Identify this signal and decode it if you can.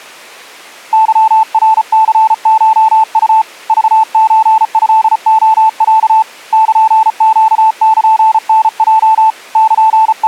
Morse code (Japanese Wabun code), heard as a keyed tone, hand-sent with a paddle, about 34 wpm, 880 Hz. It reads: ケナニコウ クソトレロ ルネルタヲ …